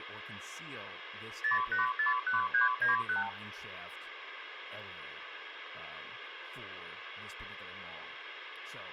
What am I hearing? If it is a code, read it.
Multi-frequency trunk signalling (R2, with the far end's replies), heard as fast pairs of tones, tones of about 140 ms, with phone line noise and speech in English. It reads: 0841391